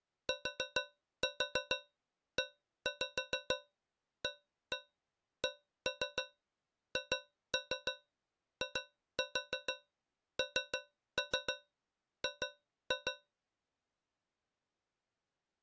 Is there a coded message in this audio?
Yes: tap code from 0.3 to 13.3 s, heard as taps on a metal pipe, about 6 knocks a second. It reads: TEACHING